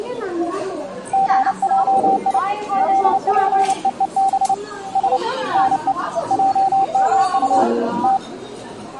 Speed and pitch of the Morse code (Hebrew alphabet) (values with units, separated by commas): 29 wpm, 780 Hz